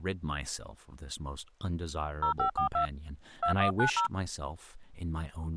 DTMF, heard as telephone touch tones, dialled by hand, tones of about 100 ms, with speech in English. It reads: 0542 2190